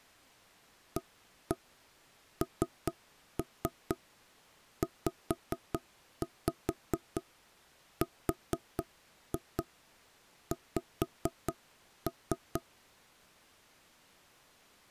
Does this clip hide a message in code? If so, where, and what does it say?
Yes: tap code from 1.0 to 12.6 s, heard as knocks on wood, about 4 knocks a second. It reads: ANZRX